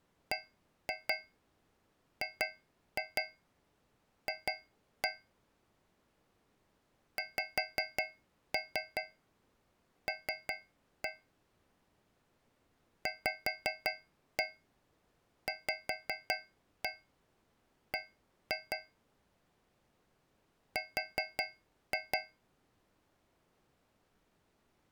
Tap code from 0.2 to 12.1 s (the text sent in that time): BGF XL